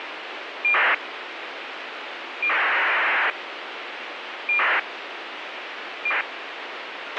ACARS aircraft data, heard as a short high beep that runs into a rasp, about 2400 baud, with radio hiss and a squelch burst at the end.